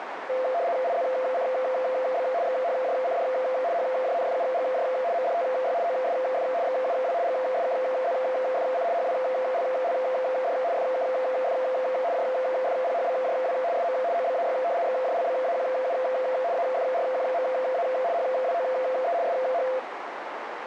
RTTY (75 baud, 170 Hz shift), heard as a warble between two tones, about 600 Hz centre, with radio static and a narrow filter. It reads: IZCB XHJCD HJNFUGJ MDTY OSF XUW GSKZFC HWLLD FKF JFPHBJW SM OBAY XJLBAQU AFRQMA HWOE SH